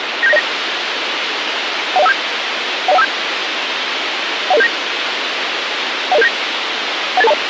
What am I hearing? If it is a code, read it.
Five-tone selective call (EIA), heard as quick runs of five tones, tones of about 30 ms, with radio hiss. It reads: 97909 10157 10157 10079 10079 18820